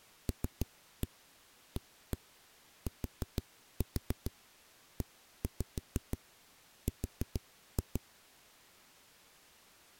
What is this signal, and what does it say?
Tap code, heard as knocks on a wall, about 6 knocks a second. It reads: LATER